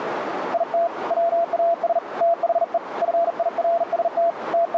Morse code, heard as a keyed tone, hand-sent with a bug key, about 40 wpm, 680 Hz, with radio static and a narrow filter. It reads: IT WAS THE FIRST …